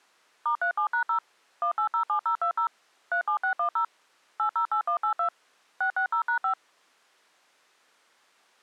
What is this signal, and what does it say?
DTMF, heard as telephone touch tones, dialled by machine, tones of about 100 ms. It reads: *37#0 1807020 37610 808182 660#5